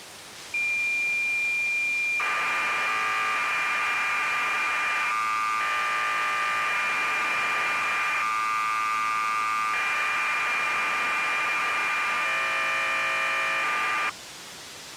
Cassette data (Kansas City type), 1200 baud, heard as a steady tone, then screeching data, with tape hiss.